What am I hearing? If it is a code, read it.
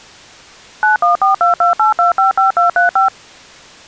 DTMF, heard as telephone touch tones, dialled by machine, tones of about 130 ms. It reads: 914228255235